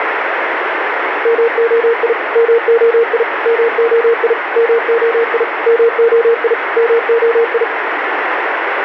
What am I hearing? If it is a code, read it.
Morse code, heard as a keyed tone, machine-sent, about 37 wpm, 460 Hz, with radio static. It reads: MOI MOI MOI MOI MOI MOI